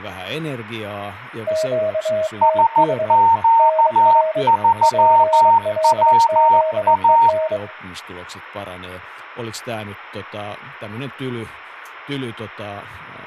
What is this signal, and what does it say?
Morse code, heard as two keyed tones, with room echo and speech in Finnish. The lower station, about 24 wpm, 630 Hz: QTH NR PLZEN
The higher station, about 14 wpm, 920 Hz: SQ3WA